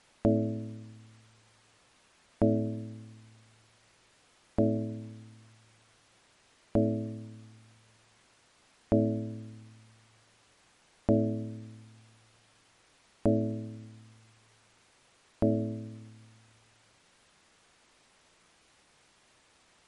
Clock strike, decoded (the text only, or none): 8